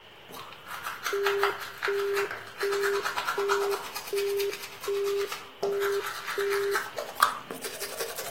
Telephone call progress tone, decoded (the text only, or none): busy tone